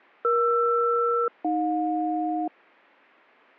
Aircraft SELCAL, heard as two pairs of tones. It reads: ER-AJ